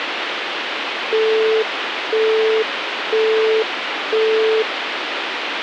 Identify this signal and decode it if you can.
Telephone call progress tone (single-tone plan, as in Europe, Japan and elsewhere), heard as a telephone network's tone, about 440 Hz, 0.5 s on and 0.5 s off, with phone line noise. Busy tone.